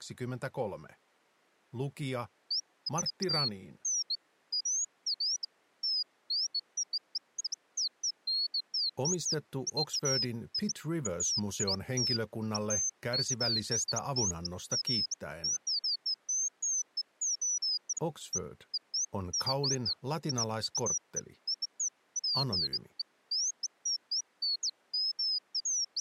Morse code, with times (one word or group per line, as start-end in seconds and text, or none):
none